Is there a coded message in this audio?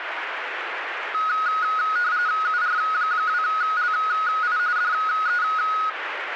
Yes: RTTY (45.45 baud, 170 Hz shift) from 1.1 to 5.9 s, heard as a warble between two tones, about 1360 Hz centre, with radio static. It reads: UR2LI DE